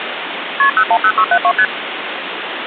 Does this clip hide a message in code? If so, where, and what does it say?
Yes: multi-frequency trunk signalling (R1, as on North American trunks) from 0.6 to 1.7 s, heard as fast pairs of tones, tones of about 70 ms, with phone line noise. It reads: KP 010672 ST